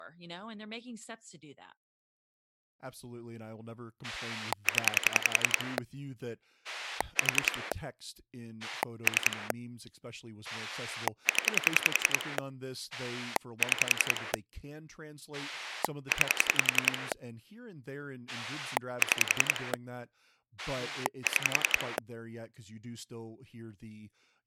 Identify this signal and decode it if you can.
Pulse dialling, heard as a rotary dial, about 10 pulses a second, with speech in English. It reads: 0 4 3 0 6 9 6 6